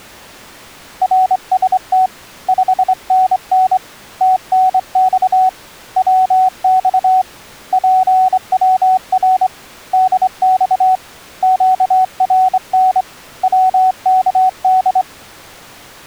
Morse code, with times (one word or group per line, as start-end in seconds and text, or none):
1.0-2.1 RST
2.5-3.8 5NN
4.2-5.5 TNX
6.0-7.2 WX
7.7-9.5 PWR
9.9-11.0 DX
11.4-13.0 QRN
13.4-15.0 WKD